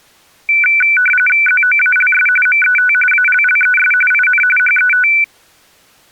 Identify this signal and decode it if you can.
RTTY (45.45 baud, 850 Hz shift), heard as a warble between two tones, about 1900 Hz centre. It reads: ZOALS MET ALLES IN HET